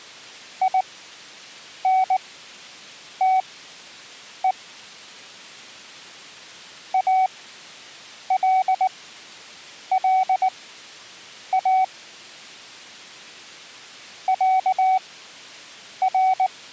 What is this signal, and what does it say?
Morse code (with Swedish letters), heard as a keyed tone, machine-sent, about 19 wpm, spaced as for 7 wpm, 750 Hz. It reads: INTE ALLA ÄR